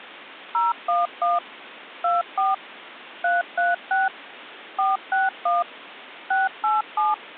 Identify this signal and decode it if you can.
DTMF, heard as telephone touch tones, dialled by machine, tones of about 170 ms. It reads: 011 24 336 461 687